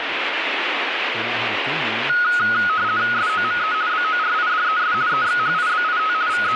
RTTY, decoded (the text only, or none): SOME BORIDES EXHIBIT …